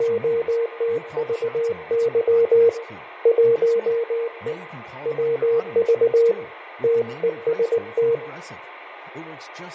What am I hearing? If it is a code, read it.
Morse code, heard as a keyed tone, hand-sent with a paddle, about 19 wpm, 460 Hz, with radio static, fading, room echo and speech in English. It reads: … 1E WV TEST